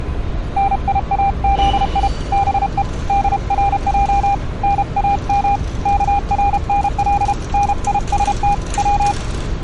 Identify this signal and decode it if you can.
Morse code (Persian alphabet), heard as a keyed tone, hand-sent with a paddle, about 32 wpm, 800 Hz, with street noise. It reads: نیازی به درج نام کرنل نیست و